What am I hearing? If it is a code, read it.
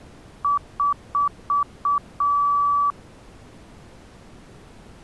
Beep code, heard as beeps, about 1150 Hz. 5 short, 1 long.